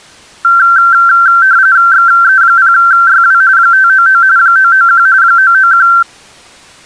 RTTY (45.45 baud, 170 Hz shift), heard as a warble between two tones, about 1460 Hz centre. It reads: XE0YW 599 991 991